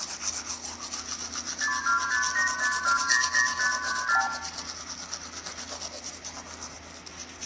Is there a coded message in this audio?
Yes: multi-frequency trunk signalling (R2, with the far end's replies) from 1.6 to 4.3 s, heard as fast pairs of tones, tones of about 120 ms, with hum, room echo and the noise of a restroom. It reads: 62585200534